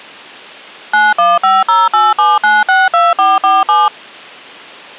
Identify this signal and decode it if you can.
DTMF, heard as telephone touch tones, dialled by machine, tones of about 200 ms. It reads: 915087962447